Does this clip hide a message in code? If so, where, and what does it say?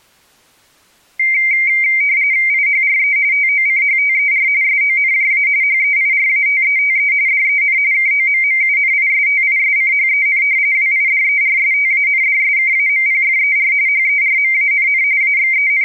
Yes: RTTY (45.45 baud, 170 Hz shift) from 1.2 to 15.9 s, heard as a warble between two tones, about 2200 Hz centre. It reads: IHRE TOCHTER SONJA HEIRATETE DEN KOMMUNISTISCHEN WIDERSTANDSKAMPFER HERMANN …